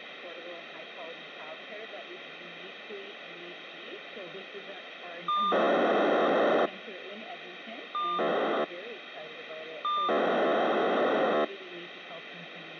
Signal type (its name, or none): POCSAG pager data